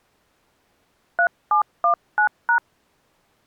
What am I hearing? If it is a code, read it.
DTMF, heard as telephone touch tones, dialled by hand, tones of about 90 ms. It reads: 3719#